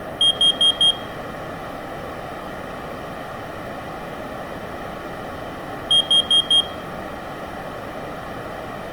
Alarm pattern, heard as an alarm's beeps, played twice, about 3250 Hz. Temporal four. Carbon monoxide.